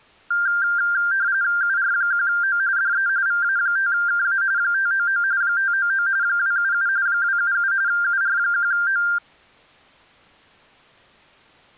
RTTY (45.45 baud, 170 Hz shift), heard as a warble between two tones, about 1490 Hz centre. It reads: UR1O DE VA5KA 599 599 277 277 UR1O